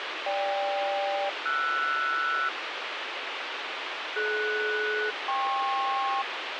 Aircraft SELCAL, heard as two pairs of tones, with radio hiss. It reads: GK-RS DS-KP